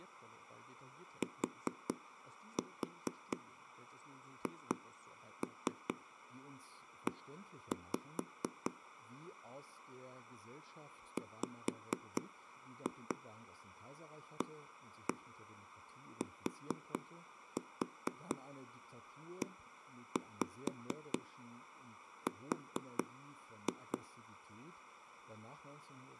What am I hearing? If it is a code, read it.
Tap code, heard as knocks on a wall, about 4 knocks a second, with speech in German. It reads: THE WATER